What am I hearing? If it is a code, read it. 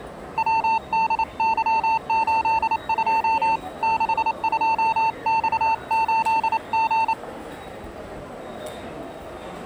Morse code, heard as a keyed tone, hand-sent with a paddle, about 28 wpm, 900 Hz, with the noise of a subway station. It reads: WDY82 62X8G